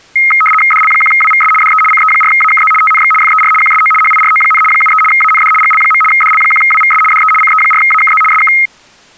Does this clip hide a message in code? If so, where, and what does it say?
Yes: RTTY (75 baud, 850 Hz shift) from 0.2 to 8.7 s, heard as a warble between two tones, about 1700 Hz centre. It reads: DL1WVS DE CE4AKZ TNX FER QSO HIRO, 73 AND GL. DL1WVS DE CE4AKZ SK